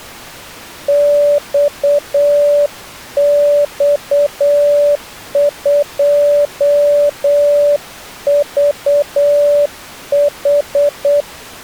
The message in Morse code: XX2VH

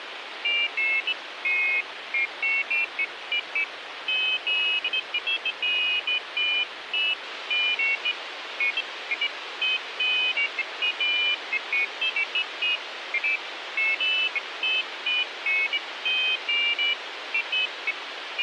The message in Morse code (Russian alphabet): none

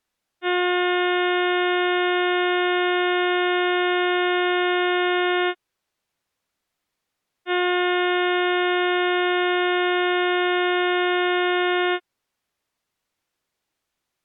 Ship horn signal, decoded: 2 long

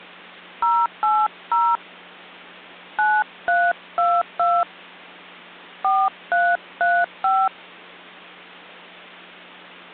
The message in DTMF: 080 9322 4335

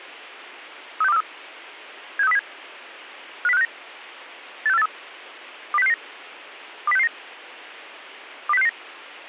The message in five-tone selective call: 36243 76307 50569 86483 20669 20669 20669

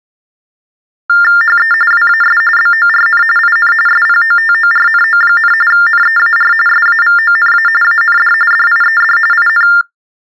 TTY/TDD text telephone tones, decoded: HE WAS BORN IN SPOTORNO, NEAR SAVONA AND DIED IN

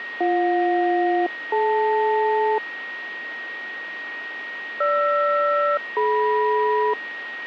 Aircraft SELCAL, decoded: BJ-DL GR-DM

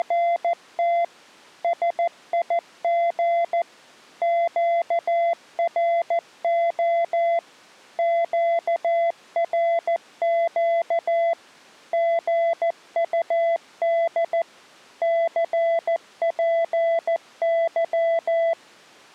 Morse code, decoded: … SIG QRO QRQ GUD CPY

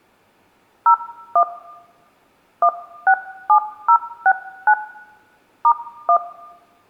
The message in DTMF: 01 167069 *1

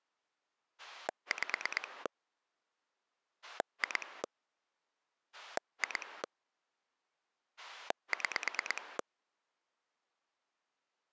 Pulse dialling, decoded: 5 2 2 6

